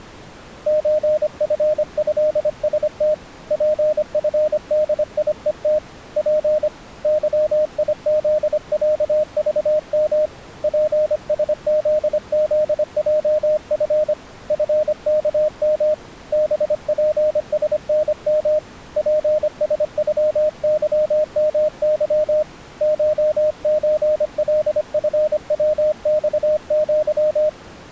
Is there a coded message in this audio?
Yes: Morse code (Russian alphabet) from 0.6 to 27.6 s, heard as a keyed tone, hand-sent with a paddle, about 25 wpm, 610 Hz. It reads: ЧФЭСТ ПФДИЕТ П ЫИЗЯЖМ ПСЗЗЙФ ФКМ БПСНМ ПСЮЫМЫ ШЧЛФВЬЪ